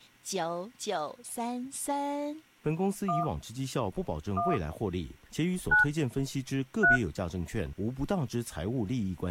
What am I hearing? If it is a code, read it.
DTMF, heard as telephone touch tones, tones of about 170 ms, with speech in Chinese. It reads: 1 1 9 3